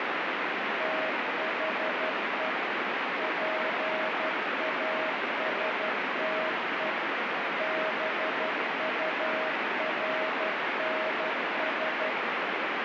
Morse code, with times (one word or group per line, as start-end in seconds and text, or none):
0.8-2.5 THE
3.2-6.9 PASTE
7.6-12.1 BURNS